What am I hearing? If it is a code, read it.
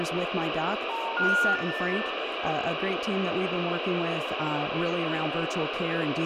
Telephone call progress tone (North American plan), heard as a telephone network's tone, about 910, 1430, 1800 Hz, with phone line noise, room echo and speech in English. Special information tone.